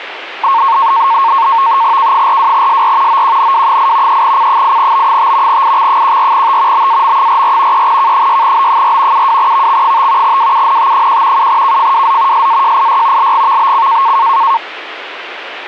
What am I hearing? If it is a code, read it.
NAVTEX (SITOR-B), 100 baud, 170 Hz shift, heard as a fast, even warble, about 1000 Hz centre, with radio static. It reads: K42SR OQNW8 3C8B5 IX14T BAM44 3K6B4 72VX5 WUNT1 7KFWZ SAJIY LGVBC